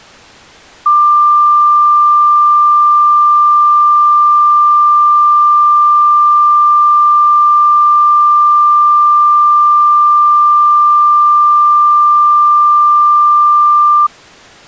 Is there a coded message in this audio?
No, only a steady tone.